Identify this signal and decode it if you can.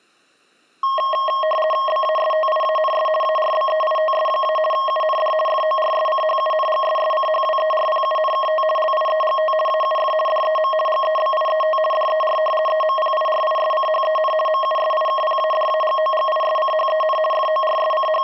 RTTY (50 baud, 450 Hz shift), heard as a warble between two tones, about 850 Hz centre, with room echo. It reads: BASTIANS ARBEITS- UND FORSCHUNGSSCHWERPUNKT LIEGT AUF DEM GEBIET DER EMPIRISCHEN MUSIKPADAGOGISCHEN …